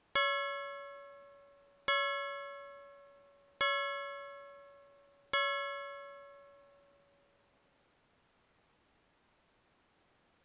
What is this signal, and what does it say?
Clock strike, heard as a bell. 4. Four o'clock.